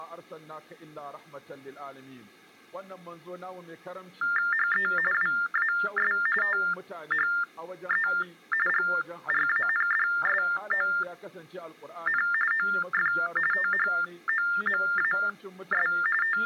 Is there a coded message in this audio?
Yes: TTY/TDD text telephone tones (45.45 baud Baudot) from 4.2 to 16.5 s, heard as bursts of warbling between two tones, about 400 Hz shift, 1600 Hz centre. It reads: HE WAS THE GRANDSON OF THOMAS …